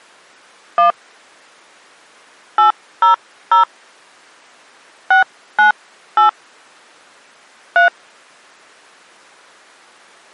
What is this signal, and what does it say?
DTMF, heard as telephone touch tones, dialled by hand, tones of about 120 ms. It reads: 1 800 698 3